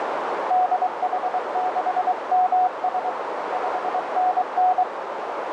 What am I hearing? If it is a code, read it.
Morse code, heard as a keyed tone, hand-sent with a paddle, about 23 wpm, 740 Hz, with heavy radio static and a narrow filter. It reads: DH6MS 5NN